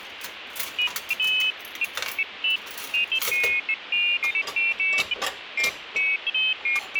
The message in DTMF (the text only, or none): none